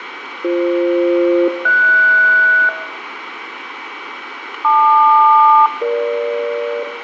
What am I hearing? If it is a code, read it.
Aircraft SELCAL, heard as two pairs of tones, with radio static and room echo. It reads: BF-HS LQ-EG